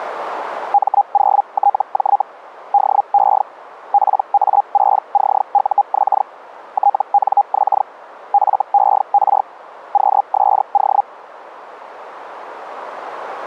Hellschreiber (Feld-Hell, 122.5 baud), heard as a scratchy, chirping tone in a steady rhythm, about 810 Hz. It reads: M0TJ DE PA6CUX TNX FER QSO